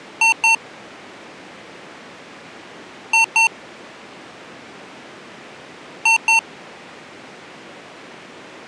Beep code, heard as beeps from a small speaker, played three times, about 900 Hz. 2 short. In AMI BIOS tables: memory parity error; in IBM BIOS tables: self-test error shown on screen; in Dell tables: no memory detected.